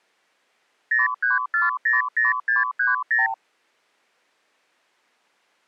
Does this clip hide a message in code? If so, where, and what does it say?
Yes: multi-frequency trunk signalling (R2, with the far end's replies) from 0.9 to 3.3 s, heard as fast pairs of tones, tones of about 160 ms. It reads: 03400630